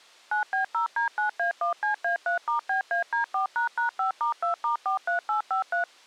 DTMF, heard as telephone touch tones, dialled by machine, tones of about 120 ms. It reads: 9B0D9A1CA3*BAD4##5*2*43853